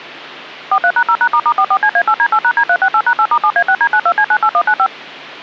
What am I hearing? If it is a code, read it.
DTMF, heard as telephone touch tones, dialled by machine, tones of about 70 ms. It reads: 43#0#**44CA8D8#D368#8*7A6D92C98195